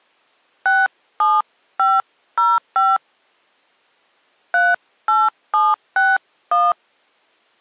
DTMF, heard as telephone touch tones, dialled by hand, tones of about 200 ms. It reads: 67505 38761